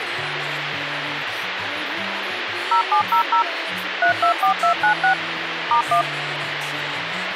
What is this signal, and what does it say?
DTMF, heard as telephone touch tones, dialled by machine, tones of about 100 ms, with phone line noise. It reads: 0700 324296 *1